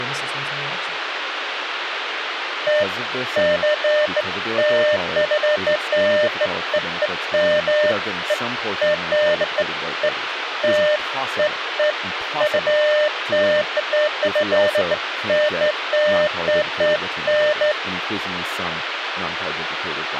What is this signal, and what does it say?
Beeps of irregular length, with radio hiss and speech in English. There is no code.